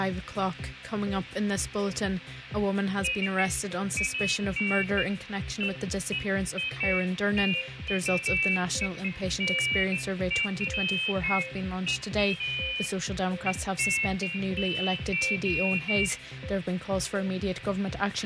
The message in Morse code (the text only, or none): none